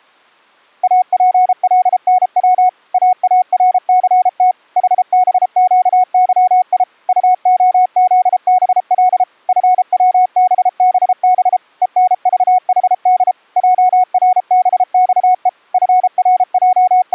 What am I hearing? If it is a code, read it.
Morse code, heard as a keyed tone, machine-sent, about 33 wpm, 730 Hz. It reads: APLNW AARCT HBQYI UOZBL FWBBB ENVHD JRBXE …